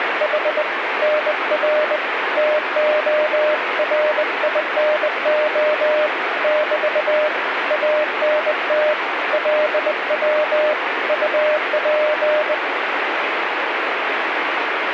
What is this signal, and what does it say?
Morse code, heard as a keyed tone, hand-sent with a bug key, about 20 wpm, 610 Hz, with radio static. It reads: … NR TORINO <BT> ANT LW UP